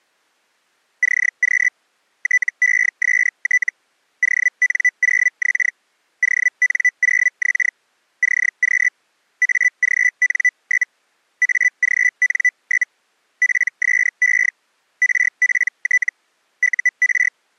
Hellschreiber (Feld-Hell, 122.5 baud), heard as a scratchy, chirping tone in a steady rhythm, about 2000 Hz. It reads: CQ TEST ON0X ON0X CQ AGN? AGN? PSE RPT UR